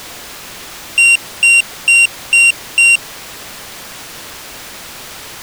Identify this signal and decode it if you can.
Beep code, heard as a piezo beeper, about 2750 Hz. 5 short. In AMI BIOS tables: processor failure; in Dell tables: CMOS battery failure.